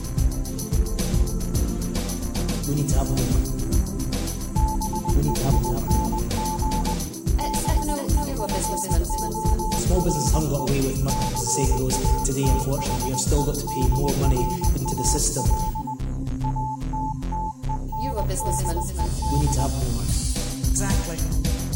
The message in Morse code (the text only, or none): BEING BEFORE CATHEDRAL ATTENDED